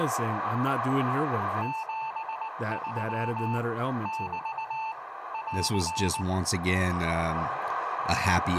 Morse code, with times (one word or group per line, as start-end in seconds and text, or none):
1.6-3.6 73
4.1-4.9 <BT>
5.3-6.2 <AR>